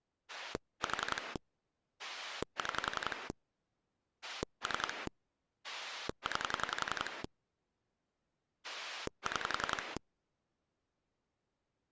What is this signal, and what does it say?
Pulse dialling, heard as a rotary dial, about 11 pulses a second. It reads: 4 6 3 9 6